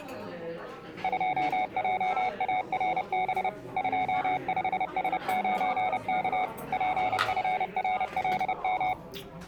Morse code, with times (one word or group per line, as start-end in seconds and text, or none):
1.0-3.5 2JARB
3.8-6.4 25S9K
6.7-8.9 PFRLM